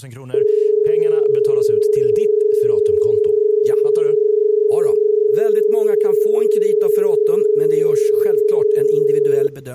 Telephone call progress tone (as in Australia), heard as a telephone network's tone, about 430 Hz, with speech in Swedish. Dial tone.